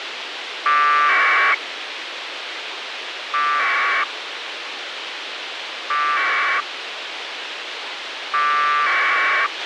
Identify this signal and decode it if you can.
Packet radio (AX.25, as in APRS), 1200 baud, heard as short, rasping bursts, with radio hiss and a squelch burst at the end.